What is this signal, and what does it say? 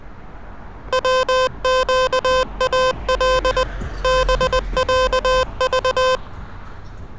Morse code (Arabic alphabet), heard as electronic beeps, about 20 wpm, 510 Hz, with street noise. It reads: وقال بعض